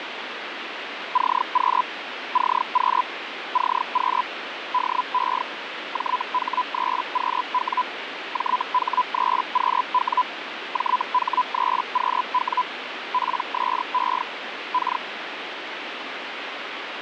Hellschreiber (Feld-Hell, 122.5 baud), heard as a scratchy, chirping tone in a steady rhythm, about 1000 Hz, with radio static. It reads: CQ CQ CQ DE JH3QW JH3QW JH3QW PSE K